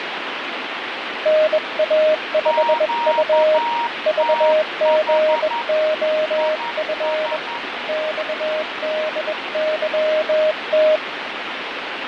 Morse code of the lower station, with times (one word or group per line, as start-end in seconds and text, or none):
1.3-3.6 NA5U
4.1-7.4 VGOF
7.9-11.0 XDYT